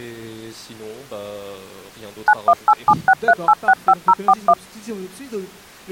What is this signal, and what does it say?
DTMF, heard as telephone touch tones, dialled by machine, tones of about 50 ms. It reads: 918763865041